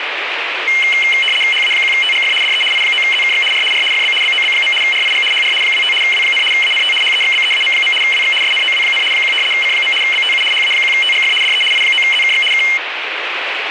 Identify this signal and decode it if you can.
RTTY (75 baud, 850 Hz shift), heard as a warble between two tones, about 2550 Hz centre, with radio static. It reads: HA1TGF DE I9ZKX R R FB BOB. RIG HR 25 W, ANT HEXBEAM. WX SNOW, 1 C. BTU HA1TGF DE I9ZKX K